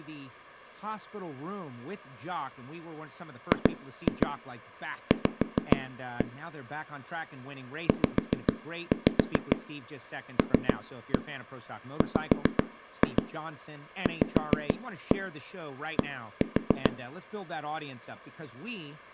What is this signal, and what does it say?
Tap code, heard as knocks on a wall, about 7 knocks a second, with speech in English. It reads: GV ZLWVD